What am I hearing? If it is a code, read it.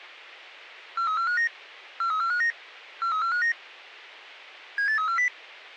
Five-tone selective call (CCIR), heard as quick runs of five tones, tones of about 100 ms. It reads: 43459 43459 43459 78340